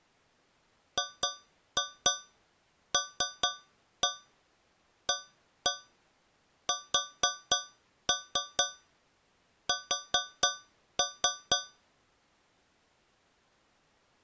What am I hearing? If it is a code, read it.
Tap code, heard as taps on a metal pipe, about 4 knocks a second. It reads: GLASS